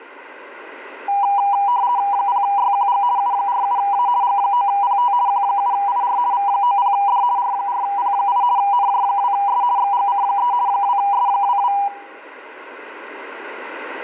RTTY (50 baud, 170 Hz shift), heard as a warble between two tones, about 890 Hz centre. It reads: 0YQG U47A G9PT Q7IR V90D R4P8 NJ2S XGC3 2S22